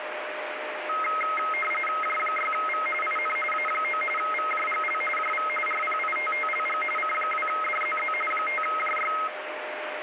RTTY (45.45 baud, 850 Hz shift), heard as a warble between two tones, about 1700 Hz centre, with radio static and a steady whistle near 610 Hz. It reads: J6V IN A9 VJGL JV RPITTLG C2DZZ 5JY